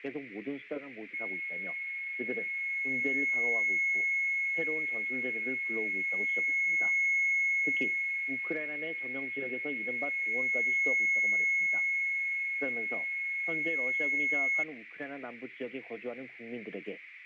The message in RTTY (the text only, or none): none